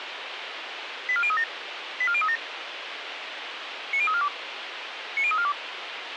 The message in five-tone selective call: 84037 84037 90342 90342

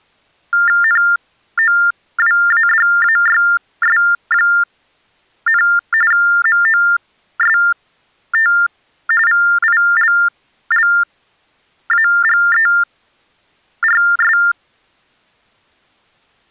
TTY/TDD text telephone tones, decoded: NOWADAYS, MOST VILLAGERS

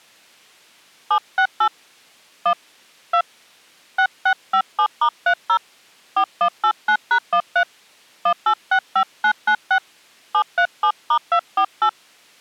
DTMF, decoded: 768 1 2 6657*30 4189#13 1865996 737*248

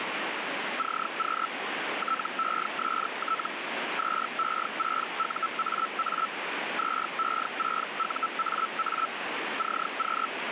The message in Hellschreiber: CQ TEST 2E6UAA 2E6UAA CQ

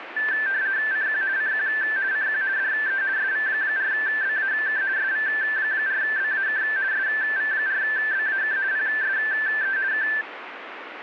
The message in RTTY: CQ CQ CQ DE SV4BAK SV4BAK SV4BAK PSE K

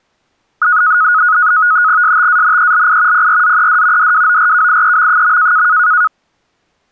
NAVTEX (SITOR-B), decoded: STANELI PRZED DWORKIEM.

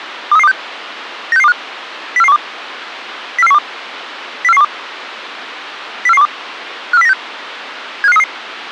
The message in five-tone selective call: 23326 96625 04412 04412 04412 04412 54096 75533

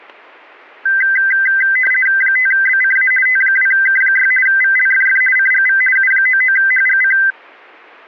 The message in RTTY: 5BCA T2K6 VLFF CGV U99HGC

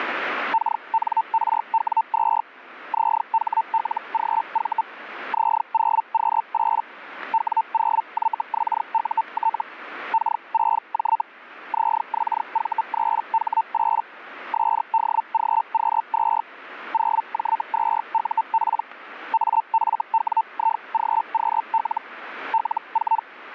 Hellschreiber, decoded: KNRW2 ZHLGV Z0Q8 W0YXUT K6J ZXV3H8 SDGQ2 0J2UP AFWIGQL L4

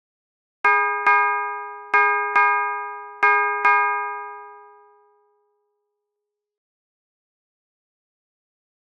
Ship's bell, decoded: 6

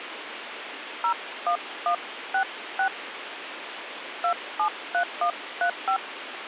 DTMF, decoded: 01166 273135

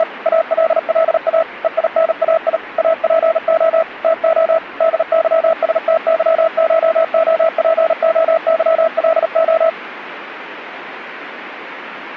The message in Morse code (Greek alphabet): … ΑΛΛΑ ΕΙΝΑΙ ΑΠΟ ΤΟ ΔΥΣΤΥΧΟΠΟΥΛΟ

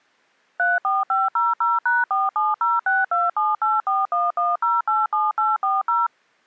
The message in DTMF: 34500#4706278411087840

